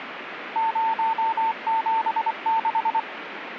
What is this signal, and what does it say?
Morse code, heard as a keyed tone, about 24 wpm, 900 Hz, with radio static. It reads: 076